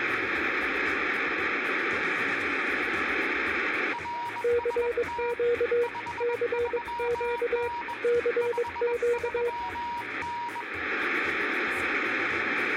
Morse code, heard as two keyed tones, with radio static and room echo. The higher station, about 21 wpm, 950 Hz: RST 53N 53N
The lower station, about 22 wpm, 480 Hz: CQ CQ CQ